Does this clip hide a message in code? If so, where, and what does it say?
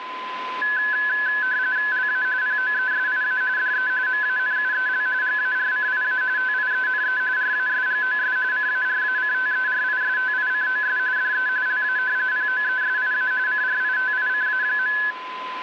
Yes: RTTY (45.45 baud, 170 Hz shift) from 0.6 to 15.1 s, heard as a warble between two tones, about 1600 Hz centre, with radio static and a steady whistle near 1020 Hz. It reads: LA POESIA DE MANUEL GARCIA TIENE RASGOS CARACTERISTICOS DE LA POESIA CRITICA.